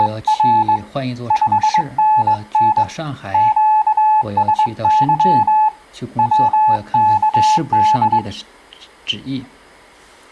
Morse code, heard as a keyed tone, hand-sent with a straight key, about 21 wpm, 860 Hz. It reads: … 5NN QSY WKD